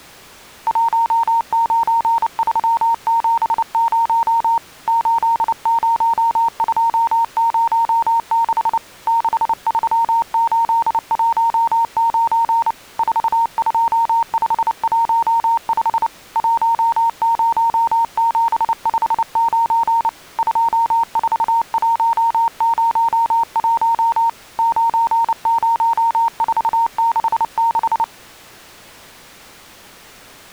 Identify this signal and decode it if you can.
Morse code, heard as a keyed tone, hand-sent with a paddle, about 29 wpm, 920 Hz. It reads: 19370 80206 63819 42515 10759 24101 90466